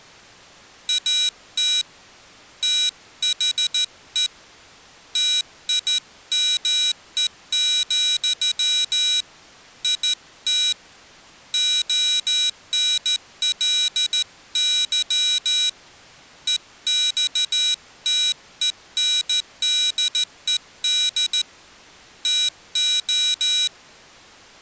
Morse code, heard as a high beeper, hand-sent with a straight key, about 14 wpm, 3900 Hz. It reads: AT THE TIME, IT ONLY EXTENDED TO